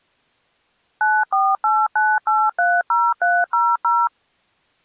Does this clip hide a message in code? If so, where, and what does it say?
Yes: DTMF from 1.0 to 4.1 s, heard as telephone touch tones, dialled by machine, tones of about 230 ms. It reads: 9489830300